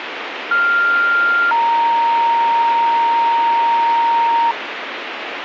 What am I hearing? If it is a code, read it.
Two-tone page, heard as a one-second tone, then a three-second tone, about 1400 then 930 Hz, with radio hiss.